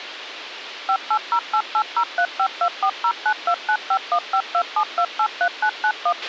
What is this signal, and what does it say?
DTMF, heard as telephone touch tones, dialled by machine, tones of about 70 ms, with radio hiss and a squelch burst at the end. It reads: 5808803524092951527283991